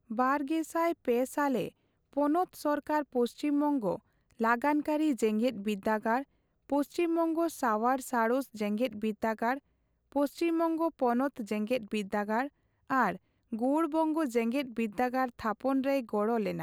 Speech in Santali. There is no code.